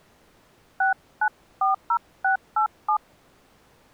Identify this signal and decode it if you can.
DTMF, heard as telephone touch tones, dialled by hand, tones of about 100 ms. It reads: 6940687